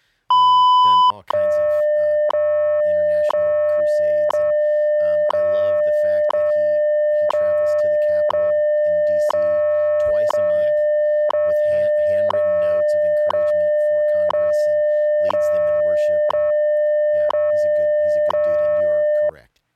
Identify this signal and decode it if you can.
Radio time signal (WWV, Colorado), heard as ticks, one a second, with speech in English.